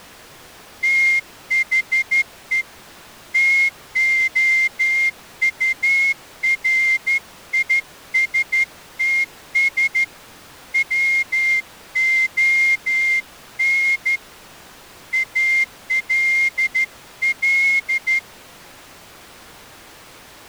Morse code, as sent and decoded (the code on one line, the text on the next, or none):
- .... . / - --- ..- .-. .. ... - ... / .-- --- -. / .- .-.. .-..
THE TOURISTS WON ALL